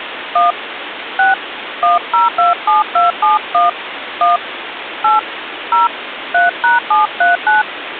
DTMF, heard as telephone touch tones, dialled by hand, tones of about 150 ms, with phone line noise. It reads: 1 6 1027271 1 8 0 3#739